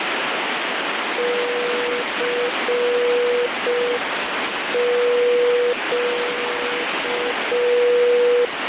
Morse code, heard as a keyed tone, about 5 wpm, 490 Hz, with heavy radio static. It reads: CQ